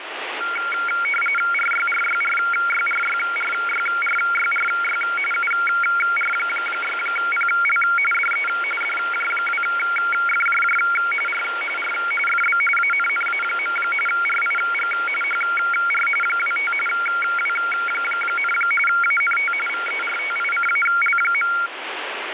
RTTY (45.45 baud, 850 Hz shift), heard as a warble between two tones, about 1800 Hz centre, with radio static. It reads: RYRYRYRYRYRYRY UR6PL DE DJ2FJJ R R FB ANNA. RIG HR 25 W, ANT VERTICAL.